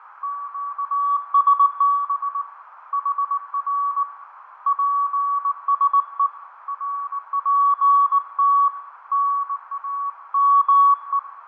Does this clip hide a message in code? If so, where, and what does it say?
Yes: Morse code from 0.2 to 11.3 s, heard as a keyed tone, hand-sent with a bug key, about 19 wpm, 1130 Hz, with radio static, fading, a narrow filter and room echo. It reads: QSB HR PSE RPT NAME